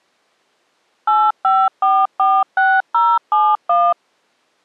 DTMF, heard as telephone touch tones, dialled by machine, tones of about 230 ms. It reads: 85446071